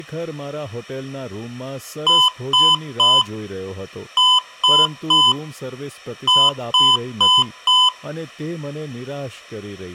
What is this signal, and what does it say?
Beep code, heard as beeps from a small speaker, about 1010 Hz, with room echo and speech in Gujarati. 3-3-4. In Phoenix BIOS tables: video failure.